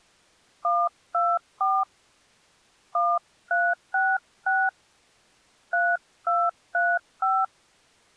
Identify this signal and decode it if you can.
DTMF, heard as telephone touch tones, dialled by hand, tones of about 230 ms. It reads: 124 1366 3235